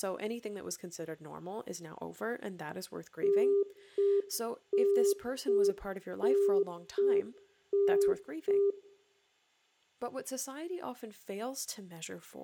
Telephone call progress tone (UK plan), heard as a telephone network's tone, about 400 Hz, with room echo and speech in English. Congestion tone.